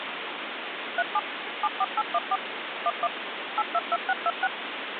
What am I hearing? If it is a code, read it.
DTMF, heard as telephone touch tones, dialled by machine, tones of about 50 ms, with phone line noise. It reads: 37 74814 11 822626